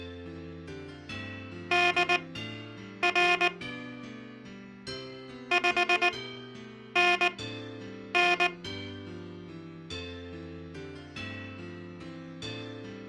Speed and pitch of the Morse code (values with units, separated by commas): 19 wpm, spaced as for 8 wpm